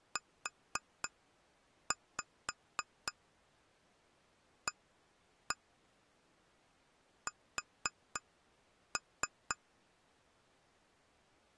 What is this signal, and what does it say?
Tap code, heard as taps on glass, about 3 knocks a second. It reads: UAS